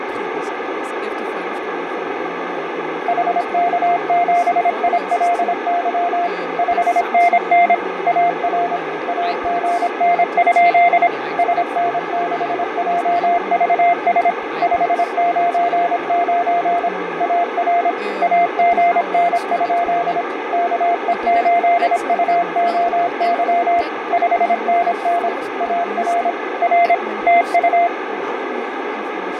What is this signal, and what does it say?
Morse code, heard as a keyed tone, machine-sent, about 26 wpm, 700 Hz, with radio static, fading, a narrow filter and speech in Danish. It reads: HK7ILY 5NN AR AGN? SN6JVS 599 AR AGN? KE8UOY 5NN AR R TU